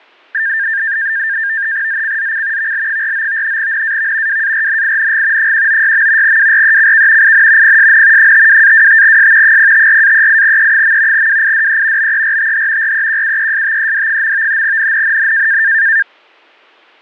NAVTEX (SITOR-B), 100 baud, 170 Hz shift, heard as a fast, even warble, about 1700 Hz centre, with fading. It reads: ZCZC VL49 NAV WARNING 196. WRECK IN PSN 52-25S 054-38E. WIDE BERTH REQUESTED. NNNN